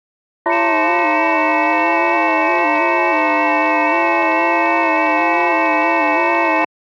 FT8 (several signals at once), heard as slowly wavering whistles, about 6.25 baud.